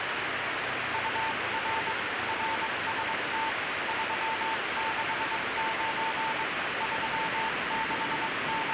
Morse code, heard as a keyed tone, hand-sent with a straight key, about 22 wpm, 890 Hz, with heavy radio static and street noise. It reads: UR RST 369 …